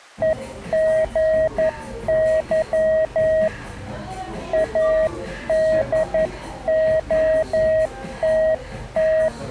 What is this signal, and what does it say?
Morse code, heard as a keyed tone, hand-sent with a paddle, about 11 wpm, 630 Hz, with the noise of a cafe. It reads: EGY ADOTT